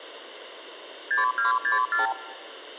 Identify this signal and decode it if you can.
Multi-frequency trunk signalling (R2, with the far end's replies), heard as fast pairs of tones, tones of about 140 ms. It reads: 6264